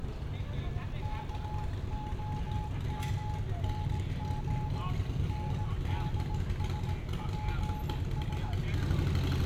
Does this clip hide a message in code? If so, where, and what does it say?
Yes: Morse code (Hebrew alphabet) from 1.0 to 8.6 s, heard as a keyed tone, hand-sent with a paddle, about 18 wpm, 850 Hz, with room echo and street noise. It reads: כהמנג נדשפש